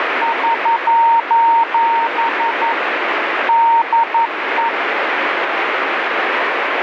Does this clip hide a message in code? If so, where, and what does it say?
Yes: Morse code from 0.2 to 4.7 s, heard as a keyed tone, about 11 wpm, 920 Hz, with radio static. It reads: <SOS> DE